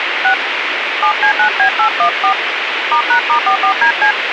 DTMF, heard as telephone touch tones, dialled by hand, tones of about 90 ms, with radio hiss. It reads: 6 7C9B814 *#*44DC